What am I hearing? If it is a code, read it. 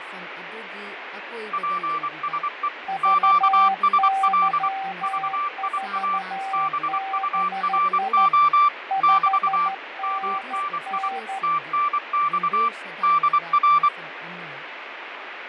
Morse code, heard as two keyed tones, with radio static, fading and speech in Manipuri. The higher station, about 24 wpm, 1170 Hz: PSE QSL VIA BURO <BT> MNI TNX DR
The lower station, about 13 wpm, 780 Hz: VY4BI 5NN